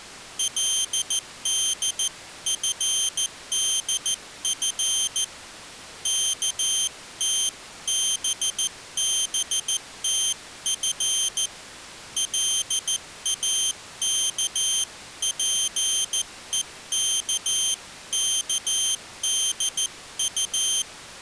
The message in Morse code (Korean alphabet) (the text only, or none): 그는 어떤 공장의